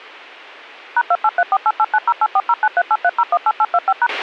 DTMF, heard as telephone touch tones, dialled by machine, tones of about 50 ms, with a squelch burst at the end. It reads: #283488908409383018825#